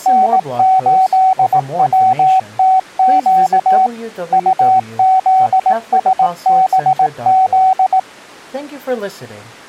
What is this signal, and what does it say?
Morse code, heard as a keyed tone, machine-sent, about 18 wpm, 760 Hz, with speech in English. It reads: N8WTQ UZSBZ